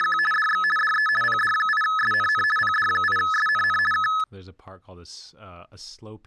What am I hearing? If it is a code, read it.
RTTY (50 baud, 450 Hz shift), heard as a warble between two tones, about 1500 Hz centre, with speech in English. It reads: … DX DE PD8SNN PD8SNN K